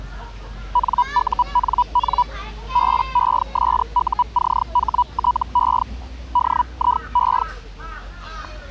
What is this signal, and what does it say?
Hellschreiber (Feld-Hell, 122.5 baud), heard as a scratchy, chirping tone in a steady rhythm, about 980 Hz, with the noise of a park. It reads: NUNN BESUCHTE DIE